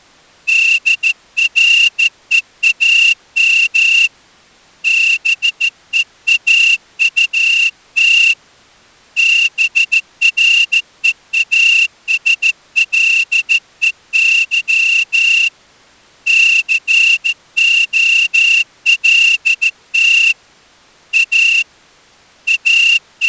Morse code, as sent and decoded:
-.. .-. . .- -- / -... . .- ..- - / -... .-. . .- ... .-.. . -.-- / -.-. --- .-.. - / .- / …
DREAM BEAUT BREASLEY COLT A …

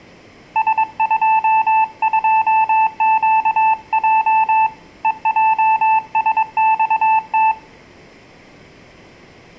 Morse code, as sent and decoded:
... ..--- ..--- --.- .--- / . .--- ... -..- -
S22QJ EJSXT

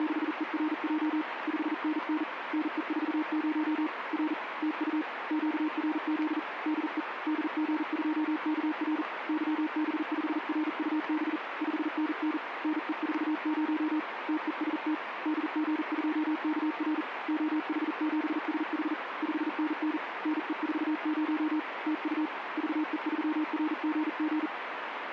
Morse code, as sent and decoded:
… / ..... -. -. / -. . ....- ----- / .-. / - ..- / --.- .-. --.. / -.. . / -.. --. ..--- -.- .-. / -.-- -... ..... .-. ..- -... / ..... -. -. / -. . ....- ----- / - . ... - / -.. --. ..--- -.- .-. / --- .... --... ... .... / ..... -. -. / -. . ....- ----- / - ..- / ...- . ...-- .-. --. --.
… 5NN NE40 R TU QRZ DE DG2KR YB5RUB 5NN NE40 TEST DG2KR OH7SH 5NN NE40 TU VE3RGG

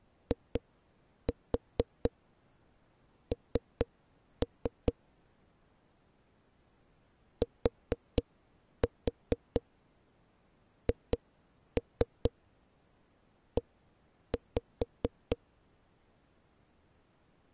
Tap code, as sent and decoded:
2-4 3-3 / 4-4 2-3 1-5
IN THE

